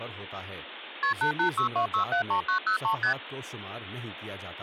Multi-frequency trunk signalling (R1, as on North American trunks), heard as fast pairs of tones, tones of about 100 ms, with phone line noise and speech in Urdu. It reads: KP 8862673903 ST